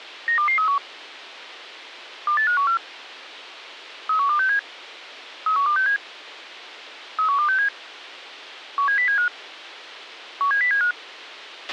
Five-tone selective call (CCIR), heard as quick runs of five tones, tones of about 100 ms, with a squelch burst at the end. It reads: 92231 28514 31267 31267 31267 17075 17075